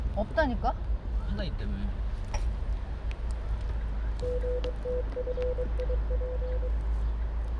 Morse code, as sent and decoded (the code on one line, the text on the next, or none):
--. - ..-. .. .--.
GTFIP